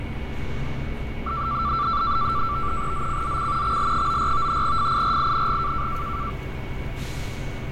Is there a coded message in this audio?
Yes: NAVTEX (SITOR-B), 100 baud, 170 Hz shift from 1.3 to 6.3 s, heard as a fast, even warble, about 1250 Hz centre, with radio static, fading, a steady whistle near 2220 Hz and street noise. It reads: ZCZC XL94 FIRING